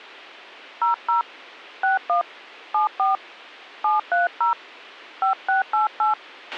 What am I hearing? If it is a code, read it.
DTMF, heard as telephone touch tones, dialled by hand, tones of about 130 ms, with a squelch burst at the end. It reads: 00 61 74 730 5688